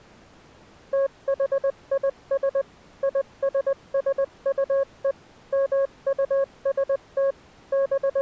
Morse code (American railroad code), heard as a keyed tone, machine-sent, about 550 Hz. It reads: THIS ISSUE MUST …